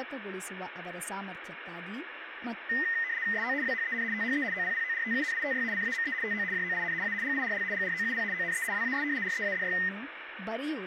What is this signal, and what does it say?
RTTY (75 baud, 170 Hz shift), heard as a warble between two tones, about 1950 Hz centre, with radio static and speech in Kannada. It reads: SO WHEN THE OPPORTUNITY CAME TO JOIN A GIRL GROUP ONE WAS READY